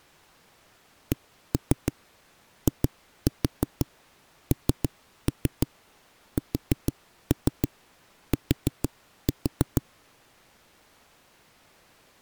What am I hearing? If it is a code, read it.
Tap code, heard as knocks on a wall, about 6 knocks a second. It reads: CINST